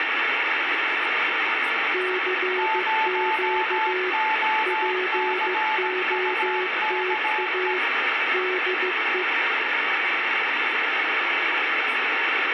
Morse code, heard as two keyed tones, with radio static and speech in English. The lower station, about 15 wpm, 370 Hz: CQ POTA DE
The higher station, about 17 wpm, 870 Hz: 0OCUKE